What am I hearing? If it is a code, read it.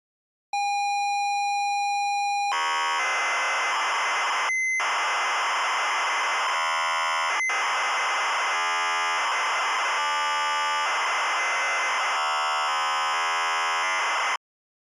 ZX Spectrum tape loading, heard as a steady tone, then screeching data.